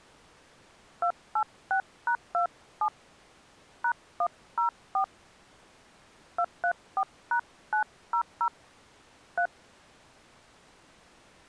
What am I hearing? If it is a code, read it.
DTMF, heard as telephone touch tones, dialled by hand, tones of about 90 ms. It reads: 286#27 #104 234#900 3